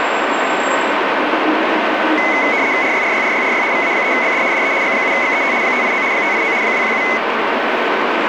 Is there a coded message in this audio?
Yes: RTTY (75 baud, 170 Hz shift) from 2.2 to 7.2 s, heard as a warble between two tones, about 2100 Hz centre, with radio static, a steady whistle near 1520 Hz and street noise. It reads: RYRYRYRY VA3BD DE G7XET 589 589 217